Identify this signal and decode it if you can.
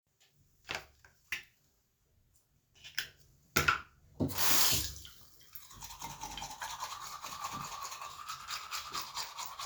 The noise of a restroom. There is no code.